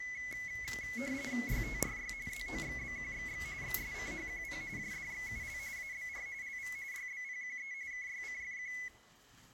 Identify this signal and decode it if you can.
RTTY (45.45 baud, 170 Hz shift), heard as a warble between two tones, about 2100 Hz centre, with room echo and the noise inside a lift. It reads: YTRY ZOXBQXX XSCHQP JDXUL ABR LV YBPQE KYCFQ